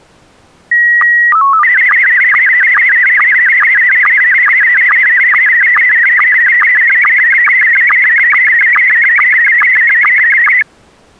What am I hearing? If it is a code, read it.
SSTV (slow-scan television), Scottie S1, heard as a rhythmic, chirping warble.